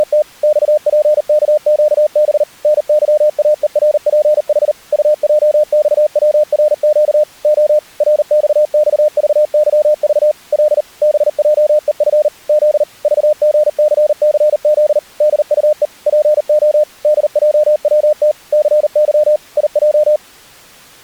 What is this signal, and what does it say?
Morse code, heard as a keyed tone, machine-sent, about 39 wpm, 600 Hz. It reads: … XPKQB NYAERPH UJXWRQ O RXXVYV L BJEF Z VGCCZ DUE PO DJWT CY IJ